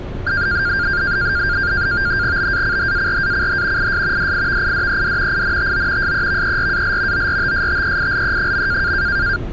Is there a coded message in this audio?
Yes: NAVTEX (SITOR-B), 100 baud, 170 Hz shift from 0.3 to 9.4 s, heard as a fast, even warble, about 1500 Hz centre, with street noise. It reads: BACHARACH IS DIVIDED INTO SEVERAL ORTSTEILE.